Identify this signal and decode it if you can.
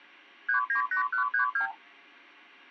Multi-frequency trunk signalling (R2, with the far end's replies), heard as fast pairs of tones, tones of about 110 ms. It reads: 398132